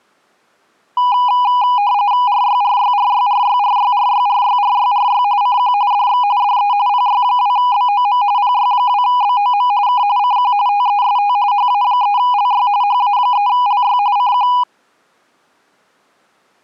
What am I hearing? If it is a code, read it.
RTTY (45.45 baud, 170 Hz shift), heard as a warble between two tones, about 900 Hz centre. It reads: RYRYRYRYRYRYRYRYRY CQ DX DE PY2BOM PY2BOM K CQ TEST HA3LY HA3LY CQ